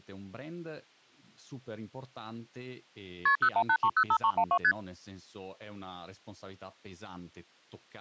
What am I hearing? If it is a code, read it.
Multi-frequency trunk signalling (R1, as on North American trunks), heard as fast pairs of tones, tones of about 70 ms, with speech in Italian. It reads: KP 018305312 ST